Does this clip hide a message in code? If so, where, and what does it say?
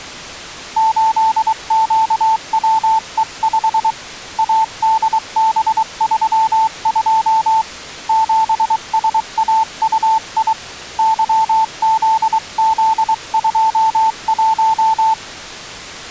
Yes: Morse code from 0.7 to 15.2 s, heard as a keyed tone, hand-sent with a paddle, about 23 wpm, 890 Hz. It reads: 8QWE5 ADB32 7SAUI YZZ21